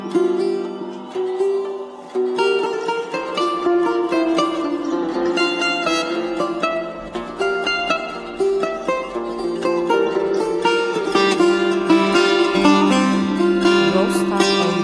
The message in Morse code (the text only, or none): none